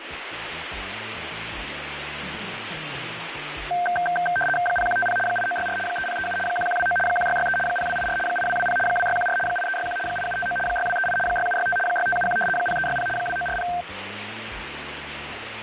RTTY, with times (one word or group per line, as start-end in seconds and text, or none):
4.7-5.2 0150
5.3-5.8 8964
5.9-6.4 3037
6.5-7.0 1129
7.1-7.6 1663
7.7-8.2 0284
8.3-8.8 8220
8.9-9.4 2614
9.5-10.0 8361
10.1-10.6 8759
10.7-11.2 6238
11.3-11.8 6765
11.9-12.4 6571
12.6-13.1 0360
13.2-13.7 2940